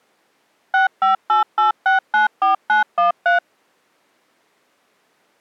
DTMF, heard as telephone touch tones, dialled by machine, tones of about 130 ms. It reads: 6588694913